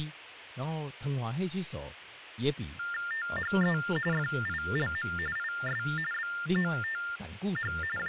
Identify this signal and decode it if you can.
TTY/TDD text telephone tones (45.45 baud Baudot), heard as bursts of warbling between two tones, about 400 Hz shift, 1600 Hz centre, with phone line noise and speech in Chinese. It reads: THE FILM IS BOTH …